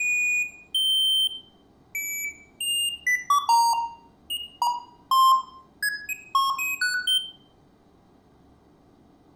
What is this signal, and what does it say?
Electronic bleeps of random pitch and length, with room echo. There is no code.